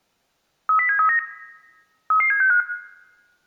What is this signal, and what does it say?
Five-tone selective call (CCIR), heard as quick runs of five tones, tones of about 100 ms, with room echo. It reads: 30739 33765